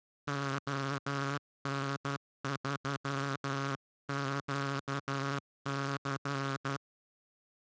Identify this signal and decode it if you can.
Morse code, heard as a buzzer, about 12 wpm. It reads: ON3QC